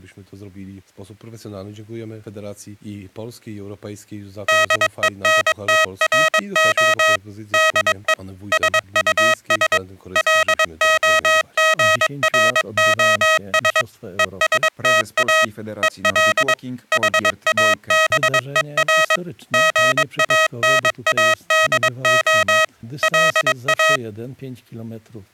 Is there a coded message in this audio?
Yes: Morse code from 4.4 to 24.0 s, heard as electronic beeps, machine-sent, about 22 wpm, 640 Hz. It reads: DENTRO DE SUS LOGROS ESTA EL HABER GANADO LA